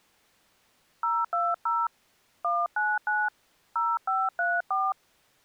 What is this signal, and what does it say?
DTMF, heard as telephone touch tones, dialled by hand, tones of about 220 ms. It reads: 020 199 0534